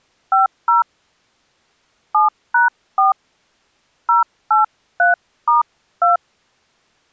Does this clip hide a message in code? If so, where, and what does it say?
Yes: DTMF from 0.3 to 6.2 s, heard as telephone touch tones, dialled by hand, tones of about 140 ms. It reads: 50 7#4 083*2